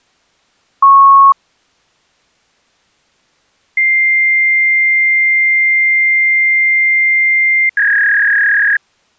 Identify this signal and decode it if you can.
Fax machine handshake, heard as a beep, a long tone and a warble.